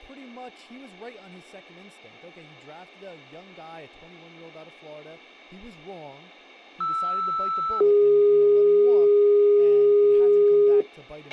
Two-tone page, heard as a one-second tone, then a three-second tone, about 1320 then 410 Hz, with a squelch burst at the end and speech in English.